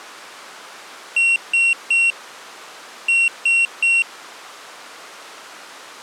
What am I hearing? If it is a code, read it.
Beep code, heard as a piezo beeper, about 2750 Hz. 3-3.